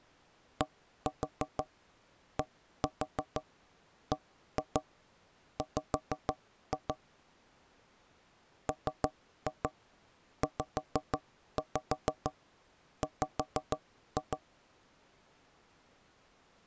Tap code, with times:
0.6-6.9 DDBW
8.7-14.4 MZW

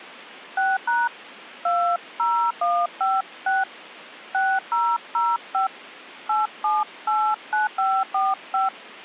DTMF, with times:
0.6-1.1 6#
1.7-3.6 20156
4.3-5.7 6005
6.3-8.7 8789545

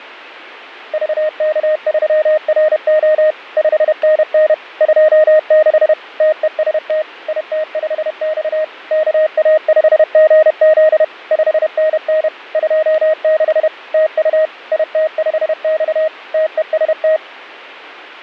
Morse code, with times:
0.9-3.3 VK3RO
3.6-4.5 5NN
4.8-5.9 26
6.2-7.0 TEST
7.3-8.6 IT5X
8.9-11.0 KA5GZ
11.3-12.3 5NN
12.5-13.7 26
13.9-14.5 TU
14.7-16.1 IT5X
16.3-17.2 TEST

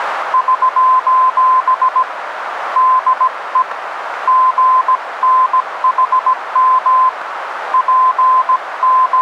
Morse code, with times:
0.3-2.0 <SOS>
2.8-3.6 DE
4.3-7.1 GNHM
7.7-9.2 …

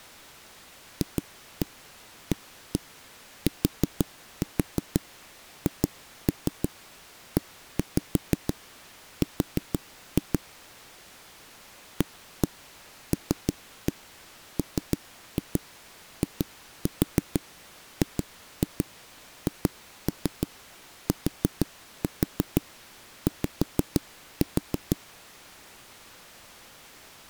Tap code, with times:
1.0-10.4 FATHER
12.0-25.0 ALMIGHTY

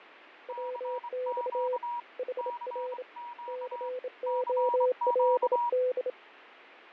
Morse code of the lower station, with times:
0.5-1.8 WX
2.2-3.0 HR
3.5-6.1 COLD

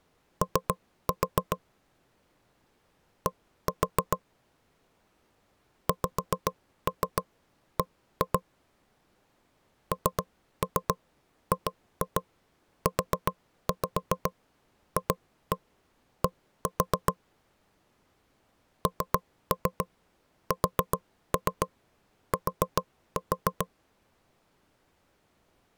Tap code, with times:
0.4-1.6 O
3.3-4.2 D
5.9-8.4 XB
9.9-17.1 NGUFD
18.9-23.7 NST

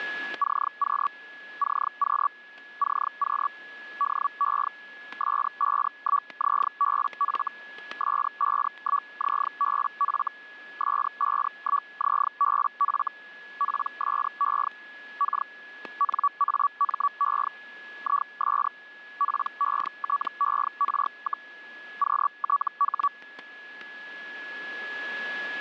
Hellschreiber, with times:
0.4-1.1 CQ
1.6-2.3 CQ
2.8-3.5 CQ
4.0-4.7 DE
5.2-7.5 S51ZBF
8.0-10.3 S51ZBF
10.8-13.1 S51ZBF
13.6-14.7 PSE
15.2-15.5 K
16.0-17.5 NAME
18.0-18.7 IS
19.2-21.5 PETER,
22.0-23.1 QTH

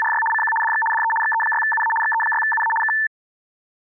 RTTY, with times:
0.0-0.2 …
0.3-0.5 CQ
0.6-0.8 DX
0.9-1.1 DE
1.2-1.9 XE6UA
2.0-2.7 XE6UA
2.8-2.9 K

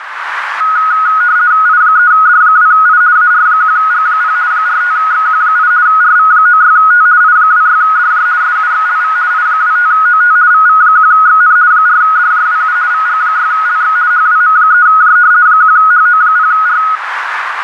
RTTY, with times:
1.7-3.0 I3D2I
3.2-4.4 AR1G0
4.5-5.7 45XQ8
5.9-7.1 RV96T
7.2-8.3 I26DJ
8.4-9.2 SUXLV
9.3-10.4 I25OT
10.5-11.6 VV1XN
11.7-12.8 4DJWU
12.9-14.0 VG6LX
14.1-15.2 HWM3J
15.5-16.8 1HO0R

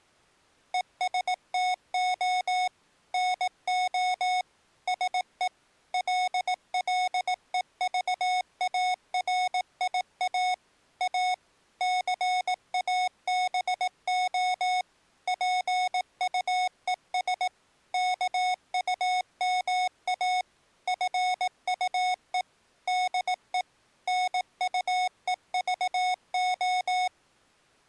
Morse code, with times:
0.7-2.7 ESTO
3.1-4.4 NO
4.9-5.5 SE
5.9-10.5 LLEVARIA
11.0-11.3 A
11.8-14.8 CABO
15.3-17.5 PUES
17.9-20.4 KUMA
20.9-22.4 FUE
22.9-23.6 DE
24.1-27.1 NUEVO

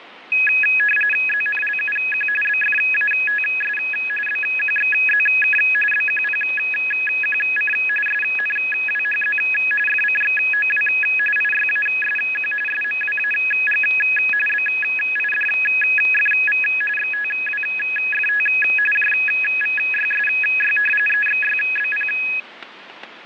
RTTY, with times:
1.3-2.3 ZNLUQ
2.4-3.8 BFATS
4.3-5.6 BQXZK
5.9-7.7 BQPQC
8.1-9.4 SNWHZ
9.9-10.9 FCXOW
11.4-12.5 IYASQ
12.7-13.8 SMWAG
14.5-16.6 BIDFV
17.0-18.5 XTWFT
18.9-20.8 JVYSY
21.1-22.1 EXYBP

